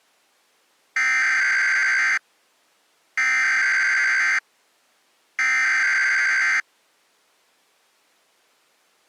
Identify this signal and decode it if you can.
Emergency Alert System (SAME) tones (header bursts), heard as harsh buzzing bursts, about 520.83 baud.